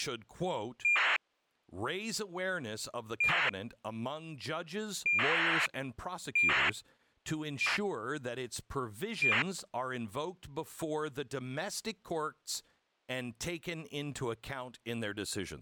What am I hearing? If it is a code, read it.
ACARS aircraft data, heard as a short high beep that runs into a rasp, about 2400 baud, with speech in English.